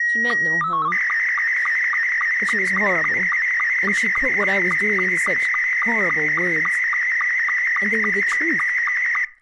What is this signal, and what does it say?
SSTV (slow-scan television), Scottie S2, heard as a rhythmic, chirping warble, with speech in English.